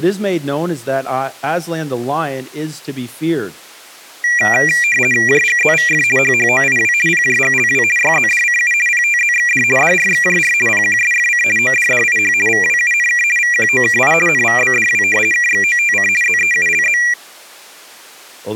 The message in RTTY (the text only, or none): JGZVF HHOIW PJGLW YZDCU PTZXD DRXJR PQSFC ODDIH VWUNK VQOKI NVBDW KXOTC ZEULZ